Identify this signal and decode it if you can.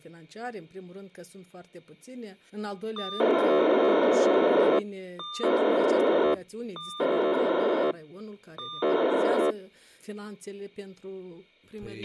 POCSAG pager data (2400 baud), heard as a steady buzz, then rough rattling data, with a squelch burst at the end.